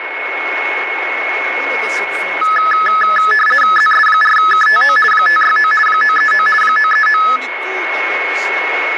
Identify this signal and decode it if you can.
RTTY (50 baud, 450 Hz shift), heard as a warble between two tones, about 1500 Hz centre, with radio static, a steady whistle near 2190 Hz and speech in Portuguese. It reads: ZS4KTO 569 939 939